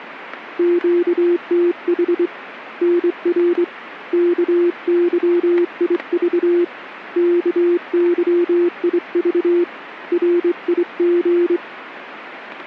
Morse code, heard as a keyed tone, hand-sent with a straight key, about 23 wpm, 350 Hz. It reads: QTH NR KYIV KYIV RIG